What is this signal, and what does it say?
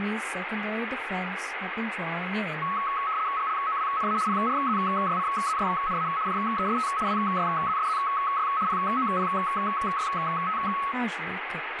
RTTY (75 baud, 170 Hz shift), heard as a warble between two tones, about 1200 Hz centre, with radio static and speech in English. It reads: GLOWNA PRZYCZYNA JEST WYZSZY POPYT